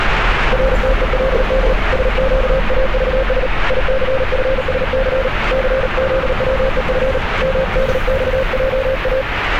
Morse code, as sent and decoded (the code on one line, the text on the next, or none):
.-. - . .-.. -.. / ... --.- .- ...- ... / .. -.-. ..-. ... -.-. / -.-. --.. .-- . ..-. / -- -.. -..- .--- .-
RTELD SQAVS ICFSC CZWEF MDXJA